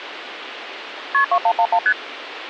Multi-frequency trunk signalling (R1, as on North American trunks), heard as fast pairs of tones, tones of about 70 ms, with phone line noise. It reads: KP 2111 ST